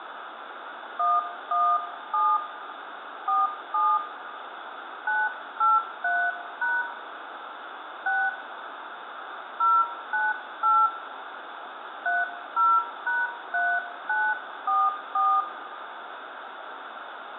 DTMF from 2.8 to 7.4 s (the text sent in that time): 47 983#